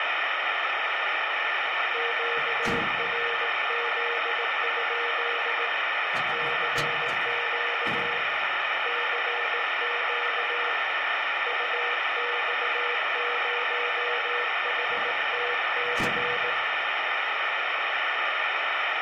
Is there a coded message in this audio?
Yes: Morse code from 1.9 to 16.6 s, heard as a keyed tone, hand-sent with a bug key, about 18 wpm, 480 Hz, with heavy radio static and room echo. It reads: QRZ? CQ CQ UX0HTC